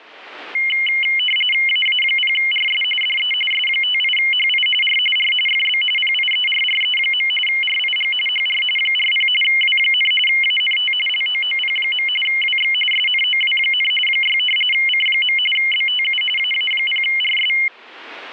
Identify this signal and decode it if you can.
RTTY (45.45 baud, 850 Hz shift), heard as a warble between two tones, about 2550 Hz centre. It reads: AA0RS DE S58HI R R FB PIERRE. RIG HR 40 W, ANT LOOP. WX SNOW, 6 C. BTU AA0RS